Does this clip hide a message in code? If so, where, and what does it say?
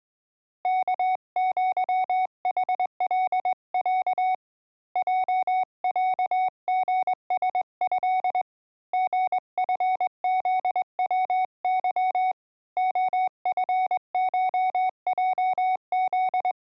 Yes: Morse code (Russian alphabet) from 0.6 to 16.6 s, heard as a keyed tone, hand-sent with a straight key, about 21 wpm, 740 Hz. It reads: КЪХЛЯ ЙЯГСЭ ГФЗВЫ ОФШЙЗ